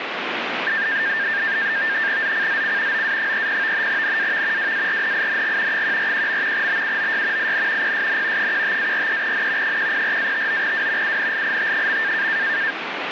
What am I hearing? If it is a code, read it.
NAVTEX (SITOR-B), 100 baud, 170 Hz shift, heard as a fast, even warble, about 1700 Hz centre, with radio static. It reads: ZCZC OA30 NAV WARNING 141. BUOY IN PSN 15-43N 104-59W UNLIT.